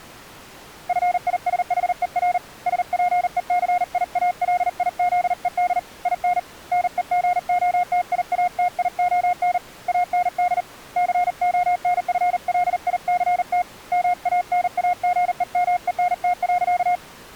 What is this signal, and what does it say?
Morse code, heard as a keyed tone, hand-sent with a paddle, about 39 wpm, 720 Hz. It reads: FISHER SPECIALIZED IN NEGOTIATION AND CONFLICT MANAGEMENT.